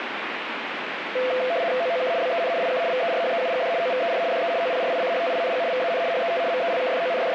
RTTY (75 baud, 170 Hz shift), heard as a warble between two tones, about 590 Hz centre, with radio static. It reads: OOK BEN IK VERHEUGD OVER DE OPRICHTING VAN HET …